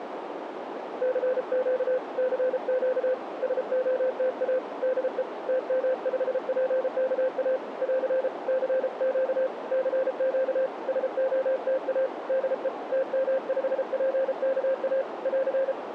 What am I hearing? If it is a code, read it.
Morse code, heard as a keyed tone, hand-sent with a paddle, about 33 wpm, 520 Hz, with radio static and a narrow filter. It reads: CQ CQ SOTA DE TM5PKA <AR> CQ CQ SOTA DE TM5PKA <AR>